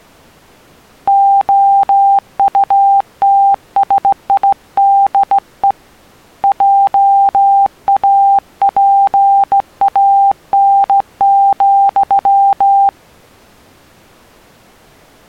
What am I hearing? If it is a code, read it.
Morse code, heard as a keyed tone, hand-sent with a straight key, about 16 wpm, 790 Hz. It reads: OUTSIDE JAPAN,